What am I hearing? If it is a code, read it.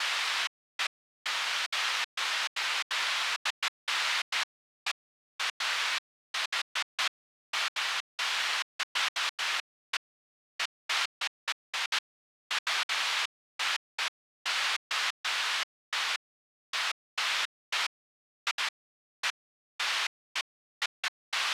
Bursts of noise. There is no code.